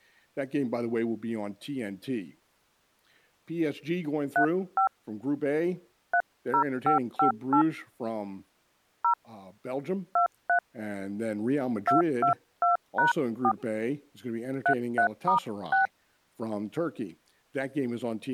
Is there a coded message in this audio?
Yes: DTMF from 4.4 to 15.9 s, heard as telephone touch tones, dialled by hand, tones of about 100 ms, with speech in English. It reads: 35 30558 0 23 222#4 33*6